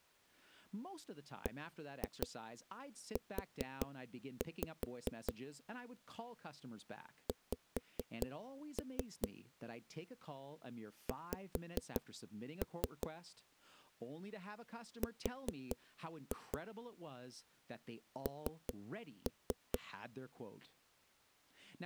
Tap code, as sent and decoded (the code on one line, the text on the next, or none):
1-2 4-5 / 5-3 / 5-3 / 4-2 / 3-3
BU X X R N